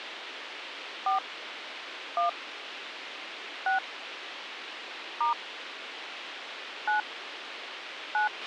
DTMF, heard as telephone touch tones, dialled by hand, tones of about 130 ms, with radio hiss and a squelch burst at the end. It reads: 4 1 6 * 9 9